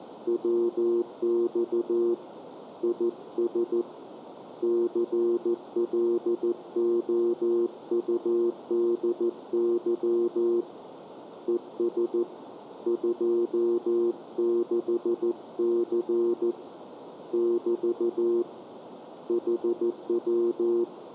Morse code, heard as a keyed tone, hand-sent with a paddle, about 14 wpm, 350 Hz, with radio static. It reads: WX IS CLOUDY ES 26C <BT> HW